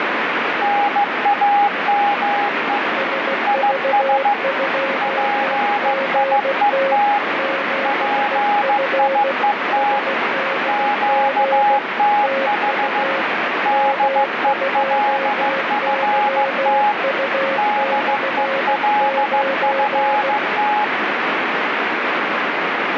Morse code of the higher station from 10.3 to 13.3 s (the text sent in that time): QTH